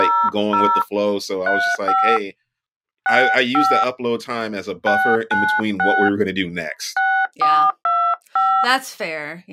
DTMF, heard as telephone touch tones, dialled by hand, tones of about 290 ms, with speech in English. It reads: 00 35 65 696 6425